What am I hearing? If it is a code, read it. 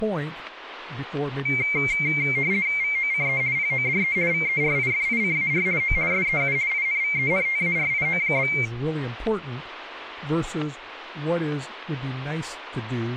RTTY (50 baud, 170 Hz shift), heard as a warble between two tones, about 2200 Hz centre, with static crashes and speech in English. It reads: VOCE PODE VERIFICAR O SEU INVENTARIO?